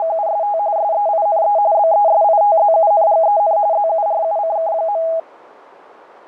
RTTY (45.45 baud, 170 Hz shift), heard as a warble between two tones, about 740 Hz centre. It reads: … SEINE BESITZUNGEN ZURUCK.